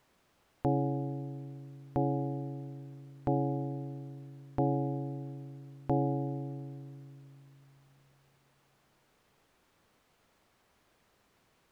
Clock strike, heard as a bell. 5. Five o'clock.